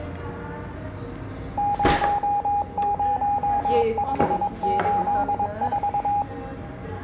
Morse code, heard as a keyed tone, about 22 wpm, 820 Hz, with room echo and the noise of a restaurant. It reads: 00584